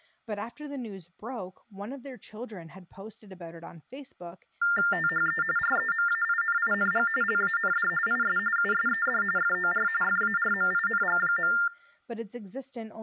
TTY/TDD text telephone tones (45.45 baud Baudot), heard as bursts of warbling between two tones, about 400 Hz shift, 1600 Hz centre, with speech in English. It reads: THE REMAINING LAND IS USED FOR FARMING.